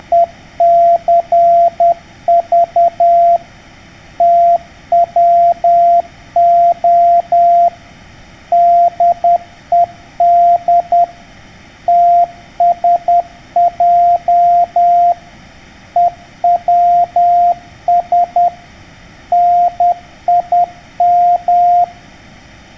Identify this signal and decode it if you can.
Morse code, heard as a keyed tone, machine-sent, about 10 wpm, 690 Hz. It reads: … TWO DED TSJ EWS NIM